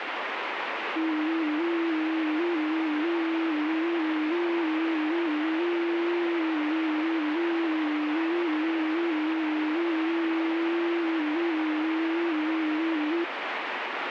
FT8 (one signal), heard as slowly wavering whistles, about 6.25 baud, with radio static.